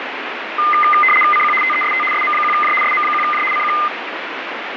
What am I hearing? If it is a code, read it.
RTTY (75 baud, 850 Hz shift), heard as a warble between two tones, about 1650 Hz centre, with radio static. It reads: CQ TEST SM1J SM1J CQ